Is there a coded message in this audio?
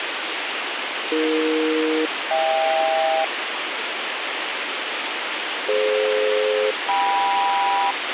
Yes: aircraft SELCAL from 1.1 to 7.9 s, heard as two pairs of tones, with radio hiss and a squelch burst at the end. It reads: AE-HK DF-KM